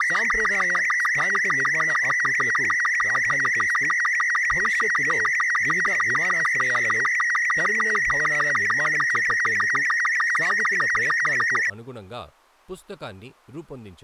SSTV (slow-scan television), Robot 36, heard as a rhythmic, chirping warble, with speech in Telugu.